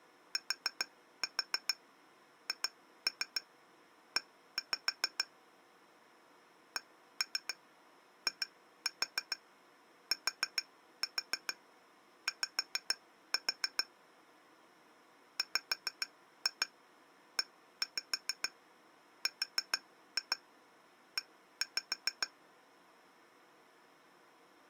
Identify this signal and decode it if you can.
Tap code, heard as taps on glass, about 6 knocks a second. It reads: THE CITY WERE